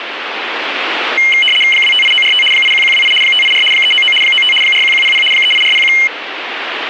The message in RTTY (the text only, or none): 258945 81128 584 399 95 41100 38401